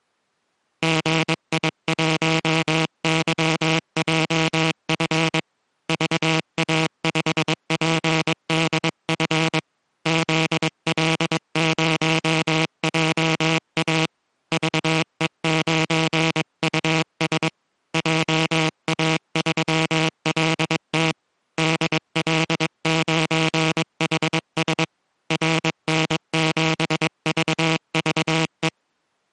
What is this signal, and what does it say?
Morse code, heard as a buzzer, hand-sent with a paddle, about 22 wpm. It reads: GI1YJF VA5PDF ZL0JA VE9US JA3LT DL9HS RN7VVE